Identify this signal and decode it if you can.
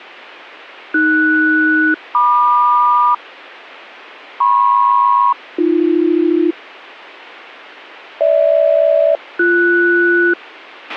Aircraft SELCAL, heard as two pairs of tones, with a squelch burst at the end. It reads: AS-MQ MP-AB GH-BS